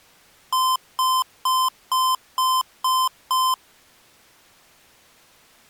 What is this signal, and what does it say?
Beep code, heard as beeps from a small speaker, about 1030 Hz. 7 short. In AMI BIOS tables: virtual mode exception error; in Dell tables: processor failure.